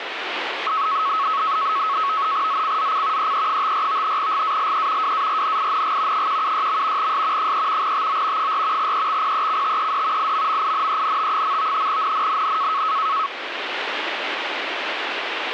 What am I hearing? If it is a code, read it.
NAVTEX (SITOR-B), 100 baud, 170 Hz shift, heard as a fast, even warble, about 1200 Hz centre, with radio static. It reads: ZCZC EE54 GALE WARNING 176. S 3 TO 4 EXPECTED IMMINENT. NNNN